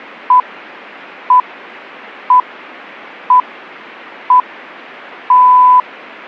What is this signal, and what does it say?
Radio time signal (six pips, as the Greenwich Time Signal), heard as pips.